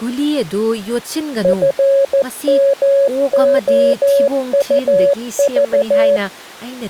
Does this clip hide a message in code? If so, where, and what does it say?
Yes: Morse code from 1.4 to 6.2 s, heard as a keyed tone, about 14 wpm, 560 Hz, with speech in Manipuri. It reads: FMOUV